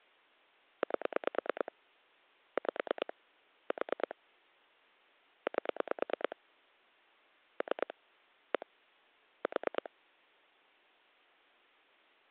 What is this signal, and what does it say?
Pulse dialling, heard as clicks on a phone line, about 9 pulses a second. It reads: 8 5 4 8 3 1 4